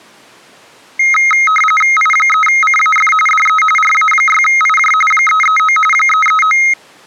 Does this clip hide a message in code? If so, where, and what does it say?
Yes: RTTY (45.45 baud, 850 Hz shift) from 1.0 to 6.7 s, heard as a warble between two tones, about 1700 Hz centre. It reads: I3CAF DE RA6IJ 339 339